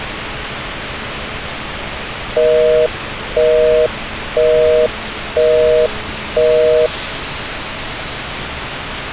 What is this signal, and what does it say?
Telephone call progress tone (North American plan), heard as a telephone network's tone, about 480, 620 Hz, 0.5 s on and 0.5 s off, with phone line noise and street noise. Busy tone.